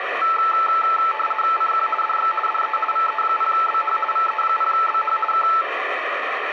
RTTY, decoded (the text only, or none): CQ DX DE VE0BH VE0BH K